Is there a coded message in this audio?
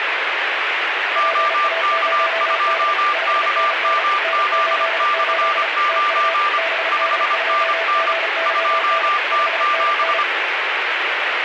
Yes: Morse code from 1.1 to 10.3 s, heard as two keyed tones, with radio static. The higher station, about 25 wpm, 1190 Hz: OK2KMZ/9 5NN 2T7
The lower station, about 35 wpm, 660 Hz: PA0D 5NN N88 TU BD2GYN 5NN